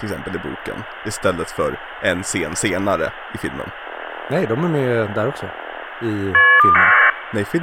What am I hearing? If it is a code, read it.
Caller ID data burst, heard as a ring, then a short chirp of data, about 1200 baud, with phone line noise and speech in Swedish.